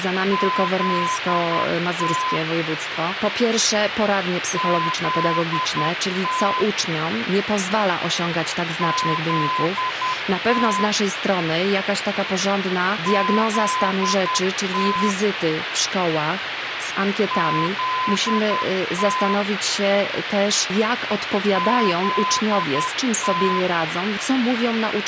Morse code, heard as a keyed tone, machine-sent, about 10 wpm, 1020 Hz, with radio hiss. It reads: ZT ZT ZT ZT ZT ZT